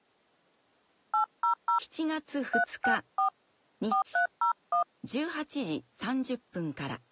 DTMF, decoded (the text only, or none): 800 364 4301